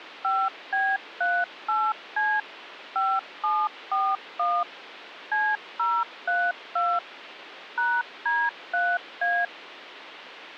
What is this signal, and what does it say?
DTMF, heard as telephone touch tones, dialled by machine, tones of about 240 ms, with phone line noise. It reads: 5B38C 5741 C032 #D3A